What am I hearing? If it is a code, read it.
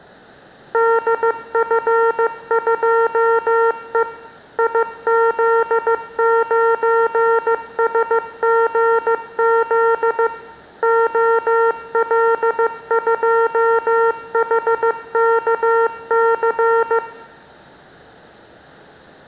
Morse code, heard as electronic beeps, machine-sent, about 15 wpm, 460 Hz, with room echo. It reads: DF2E IZ9SGZ OL2HKC